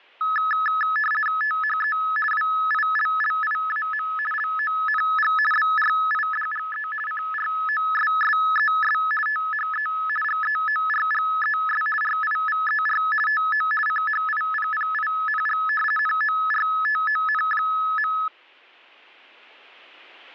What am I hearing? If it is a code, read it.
RTTY (50 baud, 450 Hz shift), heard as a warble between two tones, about 1500 Hz centre. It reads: THE WILLIAM LONG BRIDGE CROSSES THE GEORGES RIVER TO CHIPPING NORTON.